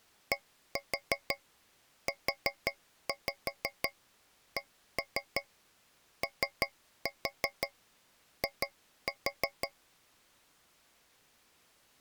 Tap code, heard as taps on a metal pipe, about 5 knocks a second. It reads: DUCOI